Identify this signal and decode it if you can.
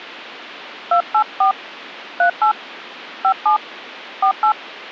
DTMF, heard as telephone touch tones, dialled by hand, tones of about 110 ms. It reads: 284 38 57 48